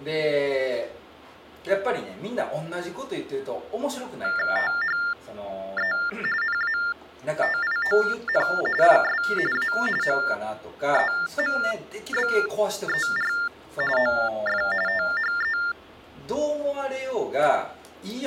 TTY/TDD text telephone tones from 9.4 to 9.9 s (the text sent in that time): A